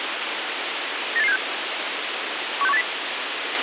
Five-tone selective call (EEA), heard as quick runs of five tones, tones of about 40 ms, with radio hiss and a squelch burst at the end. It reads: 98876 16180